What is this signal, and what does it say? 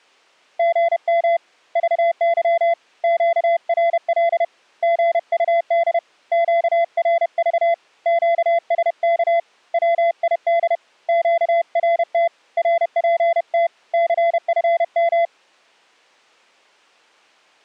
Morse code, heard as a keyed tone, hand-sent with a paddle, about 31 wpm, 680 Hz. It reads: GM VY QRL GUD QRV QSK WID QRT RPT CFM